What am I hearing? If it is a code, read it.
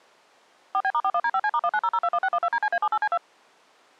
DTMF, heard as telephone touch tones, dialled by machine, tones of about 60 ms. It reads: 4B*41D5C*190021612DCA78C2